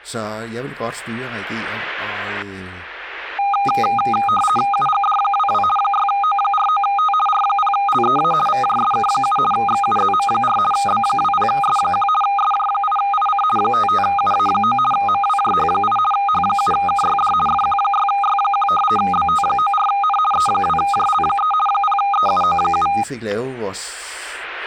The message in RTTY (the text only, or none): UGD22 6O49T R0LEA VJSK7 XUZM4 B20S1 SJ8IC 55UA9 MWJH8 H7KYD FQ6Y1 BT94N E2JL3 0EUO7